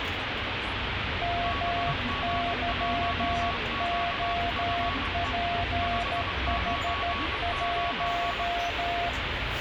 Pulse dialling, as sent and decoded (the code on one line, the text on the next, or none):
none